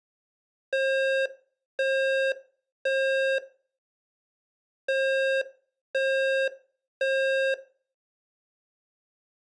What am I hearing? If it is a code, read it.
Alarm pattern, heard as an alarm's beeps, played twice, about 540 Hz, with room echo. Temporal three. Smoke or fire, evacuate.